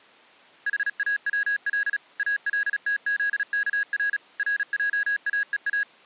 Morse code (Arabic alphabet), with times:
0.7-2.0 حاول
2.2-4.2 التذكر
4.4-5.8 رجاءا

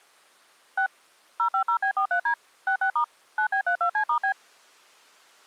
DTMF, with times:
0.8-0.9 6
1.4-2.3 050B43D
2.7-3.0 66*
3.4-4.3 9B32C*B

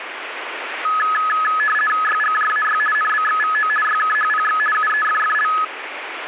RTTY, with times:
2.0-2.8 YGJAY
2.9-3.7 NBXVO
3.8-4.6 YKHPX
4.7-5.5 UEFFL

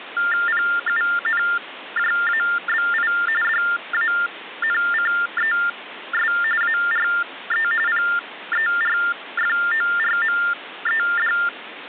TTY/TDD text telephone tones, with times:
0.5-3.1 PUNJABI
3.4-6.3 DANCES
6.6-7.7 ARE
7.9-11.3 PERFORMED

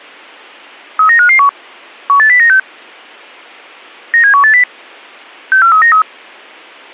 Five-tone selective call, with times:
1.0-1.5 39551
2.1-2.6 18096
4.1-4.6 97180
5.5-6.0 64393

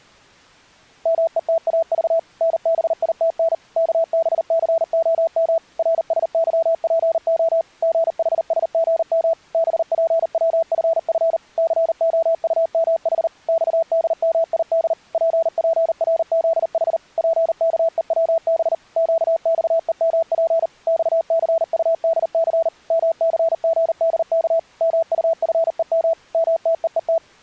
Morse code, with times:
1.1-2.2 METAV
2.4-3.5 NBITN
3.8-5.6 KBCOM
5.8-7.6 RSYPO
7.8-9.3 GHSGM
9.5-11.4 BPWFF
11.6-13.3 COUMH
13.5-14.9 XDMID
15.1-17.0 PPRZH
17.2-18.7 PKEWB
19.0-20.7 QXEMP
20.9-22.7 XCUDC
22.9-24.6 MCGDK
24.8-26.1 MUFEM
26.3-27.2 MTEET

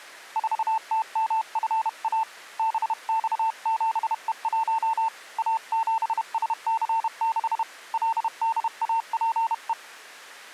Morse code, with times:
0.4-2.2 4TMFA
2.6-5.1 BX7E1
5.4-7.6 A7SC6
7.9-9.7 LDAPE

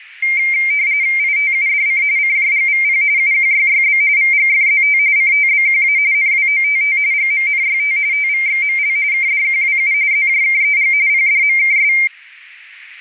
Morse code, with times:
none

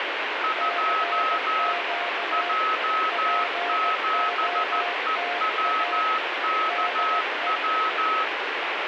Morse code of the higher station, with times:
0.4-1.7 2
2.3-8.2 J7EWKW

